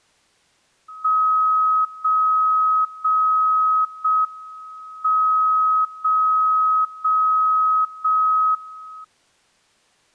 Radio time signal (JJY), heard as a tone whose level steps once a second, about 1270 Hz. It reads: 0 0 0 M 0 0 0 1